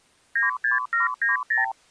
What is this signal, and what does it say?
Multi-frequency trunk signalling (R2, with the far end's replies), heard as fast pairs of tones, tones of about 140 ms. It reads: 96790